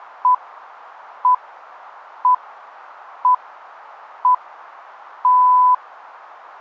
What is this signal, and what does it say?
Radio time signal (six pips, as the Greenwich Time Signal), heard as pips.